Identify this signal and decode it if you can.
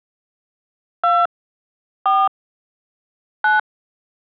DTMF, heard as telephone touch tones, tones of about 160 ms. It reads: 2 4 9